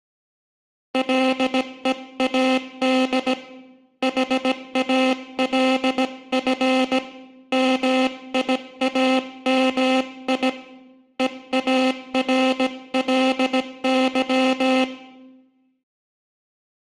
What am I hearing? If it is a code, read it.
Morse code, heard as a buzzer, hand-sent with a paddle, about 17 wpm, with room echo. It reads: LEAD HALF MIAMI EARLY